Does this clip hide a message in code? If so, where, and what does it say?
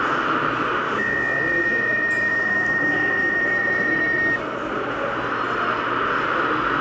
Yes: PSK63 (62.5 baud) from 1.0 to 4.4 s, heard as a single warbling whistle, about 1850 Hz, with radio static, room echo and the noise of a crowd indoors.